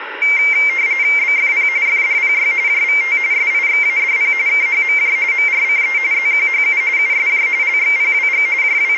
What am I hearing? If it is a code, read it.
RTTY (45.45 baud, 170 Hz shift), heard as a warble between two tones, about 2200 Hz centre, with radio static. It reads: BFP FDPY JVT SIXADP KHMJ MRCE ZQHU USJ LXPWG …